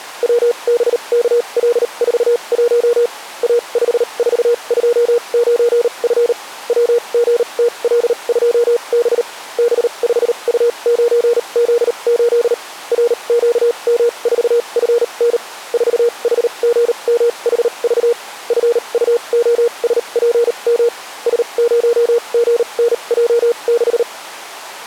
Morse code, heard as a keyed tone, machine-sent, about 38 wpm, spaced as for 30 wpm, 470 Hz. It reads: WBKL41 A5429F WGTL2B B5U9Z8 RQM4FN 4HGMHV FUOSPM S0GNJ6